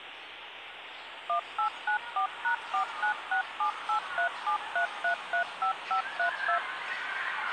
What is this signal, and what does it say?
DTMF, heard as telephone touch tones, dialled by machine, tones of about 100 ms, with the noise of a residential street. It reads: 1894#49678373335532